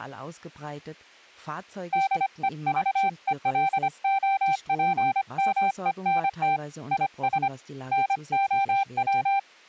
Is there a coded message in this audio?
Yes: Morse code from 1.9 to 9.5 s, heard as a keyed tone, hand-sent with a paddle, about 25 wpm, 780 Hz. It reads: DEVELOPMENT IS NOW